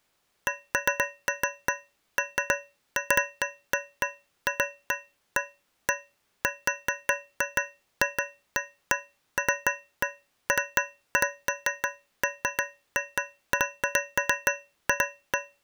Irregular taps on a metal pipe. There is no code.